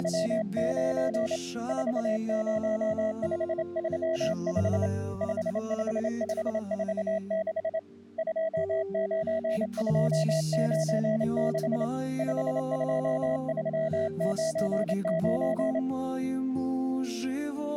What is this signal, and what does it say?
Morse code, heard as a keyed tone, hand-sent with a straight key, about 27 wpm, 650 Hz. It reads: … 40535 55546 29296 52399